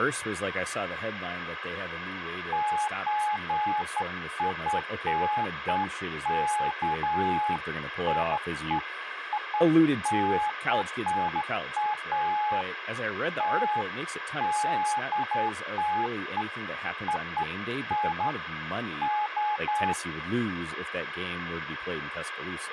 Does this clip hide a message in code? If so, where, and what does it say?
No, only beeps of irregular length, with speech in English.